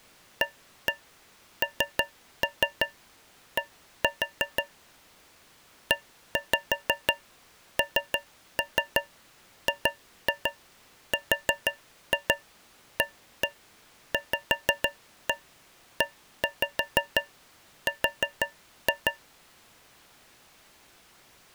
Tap code, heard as taps on a metal pipe, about 6 knocks a second. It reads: AND ENGRAVER